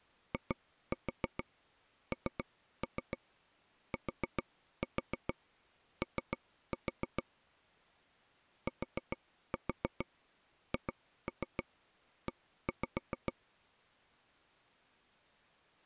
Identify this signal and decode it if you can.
Tap code, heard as taps on a table, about 7 knocks a second. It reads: INTO THE